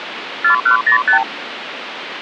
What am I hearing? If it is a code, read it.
Multi-frequency trunk signalling (R2, with the far end's replies), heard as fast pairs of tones, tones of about 100 ms, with phone line noise. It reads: 4105